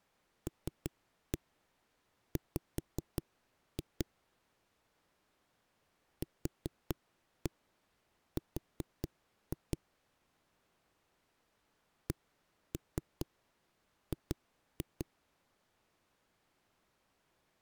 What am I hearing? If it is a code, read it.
Tap code, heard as knocks on a wall, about 5 knocks a second. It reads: LW QR CG